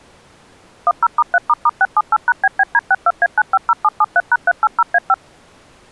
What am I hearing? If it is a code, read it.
DTMF, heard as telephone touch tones, dialled by machine, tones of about 40 ms. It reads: 10*3**678#BBD62A950773#380A5